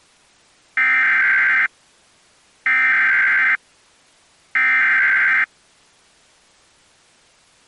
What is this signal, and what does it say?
Emergency Alert System (SAME) tones (header bursts), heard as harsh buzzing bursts, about 520.83 baud.